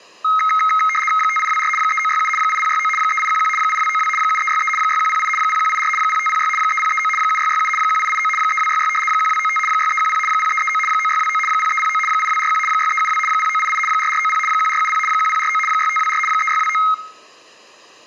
RTTY (75 baud, 850 Hz shift), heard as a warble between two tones, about 1700 Hz centre. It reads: 5824 3967 8069 3811 8292 7363 6108 0184 0506 3039 7667 1889 3266 1295 6310 0339 9629 0309 8241 6372 0988 4490 1470 1049 6524 3629